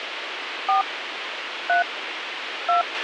DTMF, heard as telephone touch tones, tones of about 130 ms, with radio hiss and a squelch burst at the end. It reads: 4 3 2